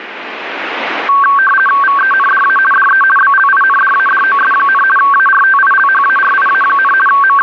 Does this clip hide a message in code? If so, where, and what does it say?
Yes: RTTY (50 baud, 450 Hz shift) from 1.1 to 7.4 s, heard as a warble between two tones, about 1340 Hz centre, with radio static. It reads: VENDA DE BLINDADOS, ARTILHARIA, …